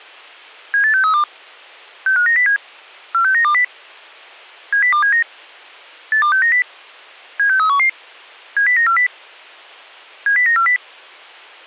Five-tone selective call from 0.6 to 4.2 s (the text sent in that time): 78632 65907 46920